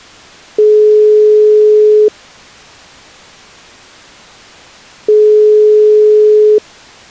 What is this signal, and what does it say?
Telephone call progress tone (single-tone plan, as in most of Europe), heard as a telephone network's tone, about 420 Hz, 1.5 s on and 3 s off. Ringback tone.